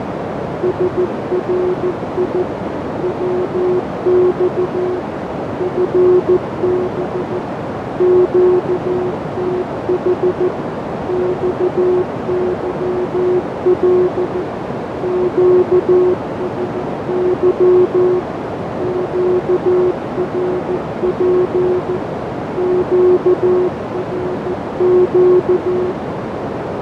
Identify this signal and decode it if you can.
Morse code, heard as a keyed tone, machine-sent, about 14 wpm, 360 Hz, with heavy radio static, fading and a narrow filter. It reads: SRI WX FB QTH XYL QSY QRP QRQ